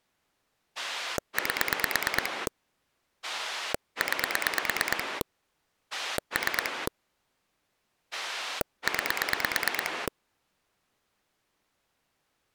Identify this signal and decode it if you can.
Pulse dialling, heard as a rotary dial, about 9 pulses a second. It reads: 8 9 3 9